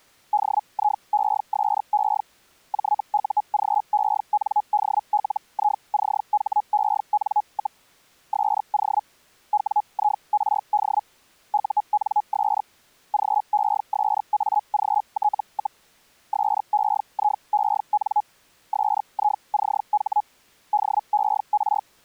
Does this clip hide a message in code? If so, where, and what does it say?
Yes: Hellschreiber (Feld-Hell, 122.5 baud) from 0.3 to 21.8 s, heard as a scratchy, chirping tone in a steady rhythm, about 840 Hz. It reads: DIESE JUGENDLICHEN, SO WIRD UNS GESAGT, SEIEN SICH DER